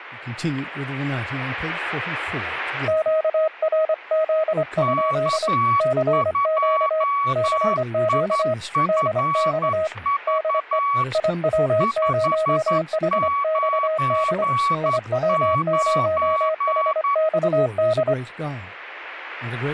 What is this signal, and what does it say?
Morse code, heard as two keyed tones, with static crashes and speech in English. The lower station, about 25 wpm, 630 Hz: QRZ? CQ CQ DX DE IW0HXD IW0HXD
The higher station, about 11 wpm, 1130 Hz: K2IFV 599